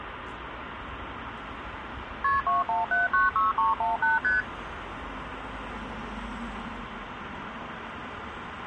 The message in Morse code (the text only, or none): none